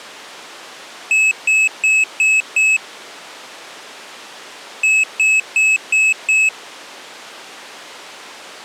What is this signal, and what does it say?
Beep code, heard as a piezo beeper, played twice, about 2600 Hz. 5 short. In AMI BIOS tables: processor failure; in Dell tables: CMOS battery failure.